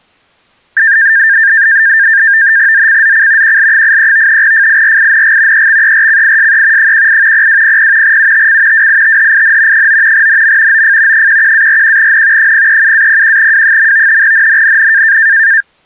NAVTEX (SITOR-B), 100 baud, 170 Hz shift, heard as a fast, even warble, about 1700 Hz centre. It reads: ZCZC QL83 FIRING EXERCISE 18 0200 UTC WITHIN 9 NM OF 11-41N 037-01W. NNNN